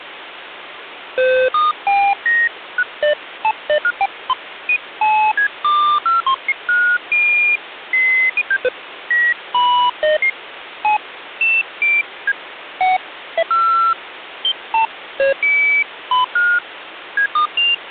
Electronic bleeps of random pitch and length, with phone line noise. There is no code.